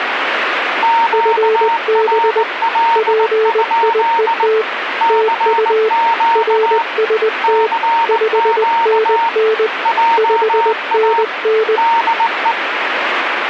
Morse code, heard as two keyed tones, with radio static. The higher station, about 19 wpm, 920 Hz: QRL? CQ CQ JA DE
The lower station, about 20 wpm, 440 Hz: FB PIET TU RST 5NN 5NN